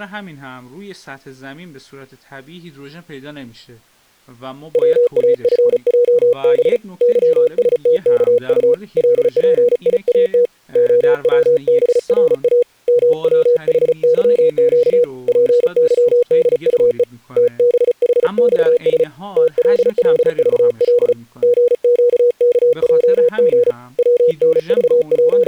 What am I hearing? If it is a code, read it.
Morse code, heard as a keyed tone, hand-sent with a paddle, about 35 wpm, 480 Hz, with speech in Persian. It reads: WAFJB YSTKU LPIAT OWBRA MWHYQ PYDUE TBHXS TLLVL GQKJG …